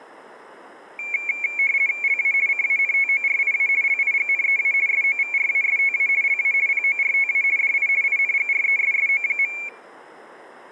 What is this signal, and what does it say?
RTTY (50 baud, 170 Hz shift), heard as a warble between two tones, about 2300 Hz centre, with room echo. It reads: LA CANTORIA LIGNEA SOVRASTA LA PORTA DI INGRESSO.